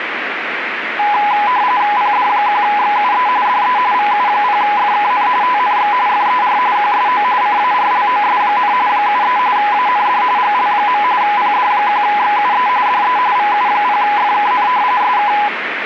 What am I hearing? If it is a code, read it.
RTTY (45.45 baud, 170 Hz shift), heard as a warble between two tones, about 920 Hz centre, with radio static. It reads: PD1XUE DE VU0FKN TNX FER QSO CARLOS, 73 AND GL. PD1XUE DE VU0FKN SK